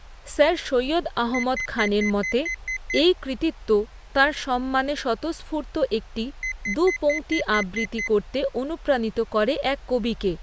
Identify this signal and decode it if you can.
Beep code, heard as a piezo beeper, played twice, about 2050 Hz, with speech in Bangla. 8 short. In AMI BIOS tables: display memory failure; in Dell tables: LCD failure.